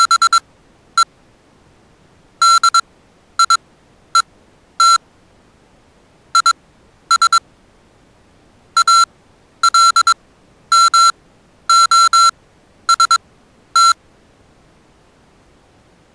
Morse code, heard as electronic beeps, machine-sent, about 22 wpm, spaced as for 11 wpm, 1360 Hz. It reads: … DIET IS ALMOST